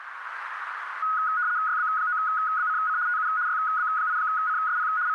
RTTY (75 baud, 170 Hz shift), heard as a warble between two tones, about 1360 Hz centre, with radio static and a narrow filter. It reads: YB9BCC TU YB8CSP …